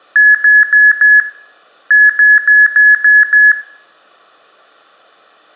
Beep code, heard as beeps, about 1700 Hz, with room echo. 4-6.